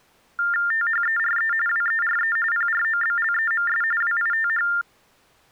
TTY/TDD text telephone tones (45.45 baud Baudot), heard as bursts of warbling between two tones, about 400 Hz shift, 1600 Hz centre. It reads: THERE WERE PROBLEMS WITH